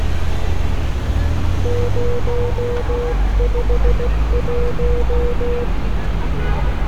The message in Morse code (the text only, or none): 051